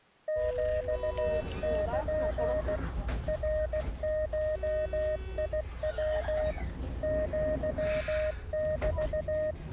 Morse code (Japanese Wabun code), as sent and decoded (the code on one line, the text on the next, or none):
--..- -.--. / .-. ---- .. .-- / --.-- -...-
ヒル ナゴヤ アメ